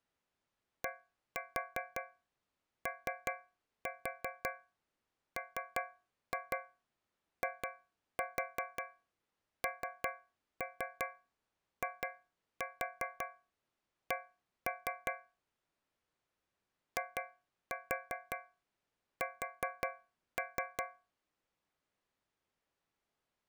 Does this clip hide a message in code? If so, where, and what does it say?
Yes: tap code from 0.8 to 21.1 s, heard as taps on a metal pipe, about 5 knocks a second. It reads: DOMINIC IS